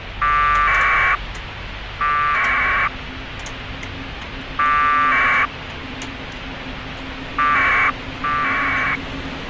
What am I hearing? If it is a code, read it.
Packet radio (AX.25, as in APRS), 1200 baud, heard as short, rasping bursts, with radio hiss, a squelch burst at the end and street noise.